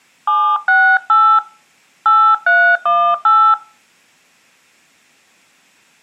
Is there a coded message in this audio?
Yes: DTMF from 0.3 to 3.5 s, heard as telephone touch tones, dialled by hand, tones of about 290 ms. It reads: 768 8318